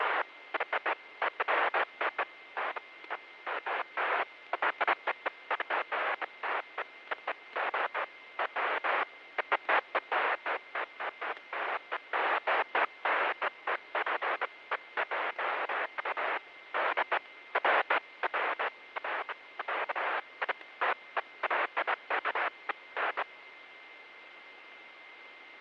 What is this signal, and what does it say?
Bursts of noise, with radio static, fading and a steady whistle near 2090 Hz. There is no code.